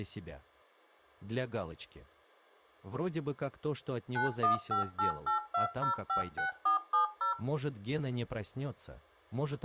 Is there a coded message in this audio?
Yes: DTMF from 4.2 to 7.3 s, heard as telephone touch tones, dialled by machine, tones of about 120 ms. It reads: 915882056470